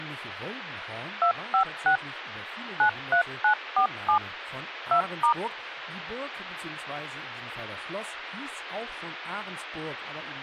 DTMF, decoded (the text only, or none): 256 93947 2*